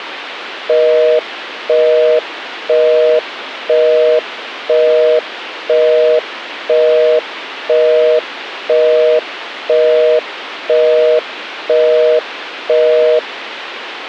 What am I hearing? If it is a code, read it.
Telephone call progress tone (North American plan), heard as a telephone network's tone, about 480, 620 Hz, 0.5 s on and 0.5 s off, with phone line noise. Busy tone.